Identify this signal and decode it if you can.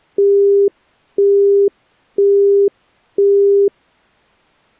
Telephone call progress tone (single-tone plan, as in Europe, Japan and elsewhere), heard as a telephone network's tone, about 400 Hz, 0.5 s on and 0.5 s off. Busy tone.